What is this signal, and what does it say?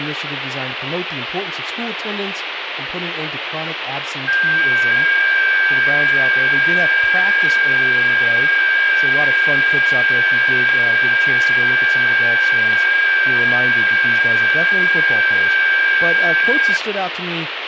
FT8 (several signals at once), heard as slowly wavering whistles, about 6.25 baud, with radio static and speech in English.